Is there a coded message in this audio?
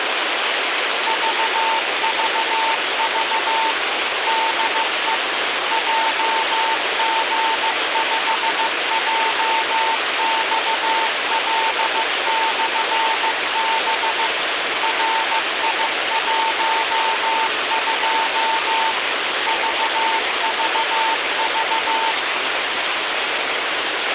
Yes: Morse code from 1.0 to 22.2 s, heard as a keyed tone, machine-sent, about 15 wpm, 900 Hz, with radio hiss and a squelch burst at the end. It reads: VVV DE JG5JXL/B RI12 VVV